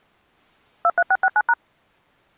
DTMF, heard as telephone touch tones, dialled by machine, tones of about 50 ms. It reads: 23669#